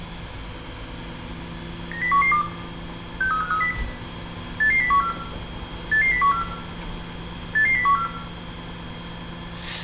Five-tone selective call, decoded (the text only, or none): 90112 63530 88014 88014 88014